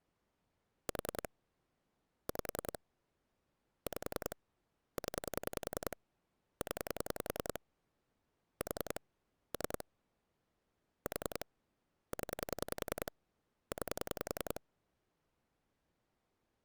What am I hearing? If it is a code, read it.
Pulse dialling, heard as clicks on a phone line, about 10 pulses a second. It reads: 4 5 5 0 0 4 3 4 0 9